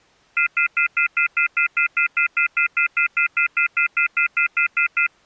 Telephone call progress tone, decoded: off-hook warning tone

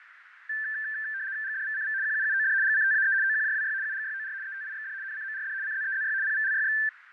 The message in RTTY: GDVCV QUUOD GCTAE OQJWY UGYOR ETIXD NCMRD CZEZY PVLYX

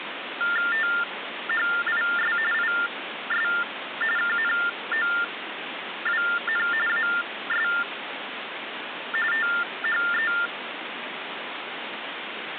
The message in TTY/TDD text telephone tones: THIS IS KNOWN AS THE

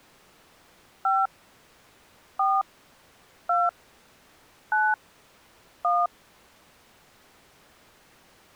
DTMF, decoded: 5 4 2 9 1

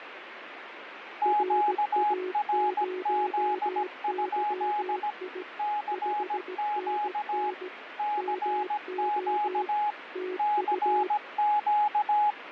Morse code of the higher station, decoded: QRZ? CQ CQ CQ

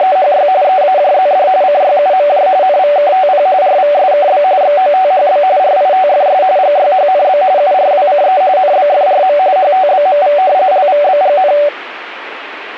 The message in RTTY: … EAJZD CYUMJ NVKTP RVSKB XOTHB RITFS GYHNB URWCE NBFRM HTBMV LVBGN

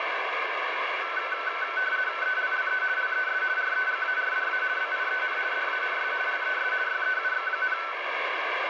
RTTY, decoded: ELLE LES REGARDA BIEN DANS LES YEUX,

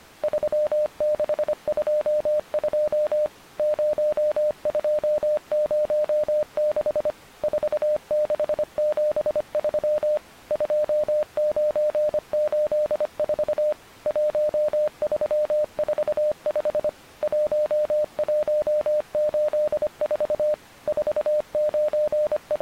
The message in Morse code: 3622 0206 4673 2984 1345 1184 …

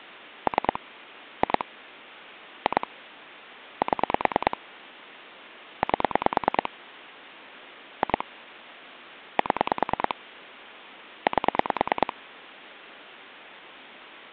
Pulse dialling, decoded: 3 2 2 7 8 2 7 8

